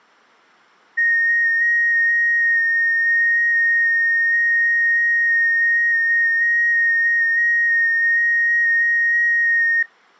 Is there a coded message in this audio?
Yes: FT8 (one signal) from 1.0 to 9.8 s, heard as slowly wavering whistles, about 6.25 baud.